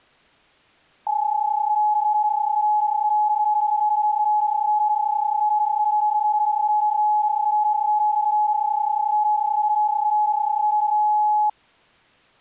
PSK31 (31.25 baud), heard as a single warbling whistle, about 840 Hz.